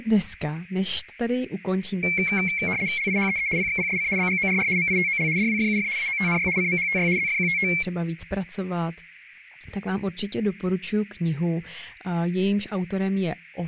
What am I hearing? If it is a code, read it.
RTTY (75 baud, 170 Hz shift), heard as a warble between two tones, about 2250 Hz centre, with radio static and speech in Czech. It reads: LIHEE PXPSC BGORR MITOL DWFUF AOTNY CMHTY ZFQTT